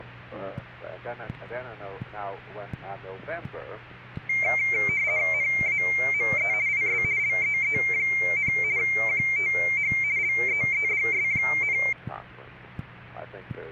RTTY (50 baud, 170 Hz shift), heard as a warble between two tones, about 2200 Hz centre. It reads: NAME IS LEE, QTH LEEDS,